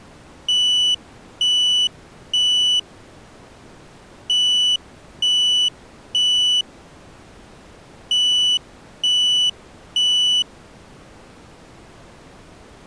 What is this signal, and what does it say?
Alarm pattern, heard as an alarm's beeps, played three times, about 2950 Hz. Temporal three. Smoke or fire, evacuate.